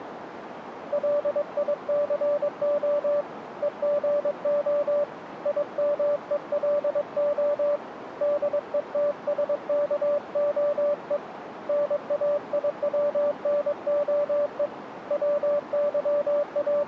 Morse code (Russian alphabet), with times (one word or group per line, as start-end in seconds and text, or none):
0.9-3.2 ЛИЦО
3.6-5.0 ЕГО
5.5-7.8 ИМЕЛО
8.2-11.2 ДЕТСКОЕ
11.7-14.7 НАИВНОЕ
15.1-16.9 …